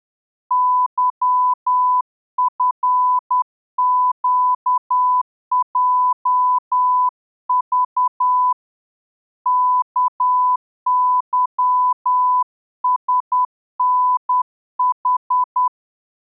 Morse code, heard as a keyed tone, hand-sent with a straight key, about 10 wpm, 1000 Hz. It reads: YFQJV KYSNH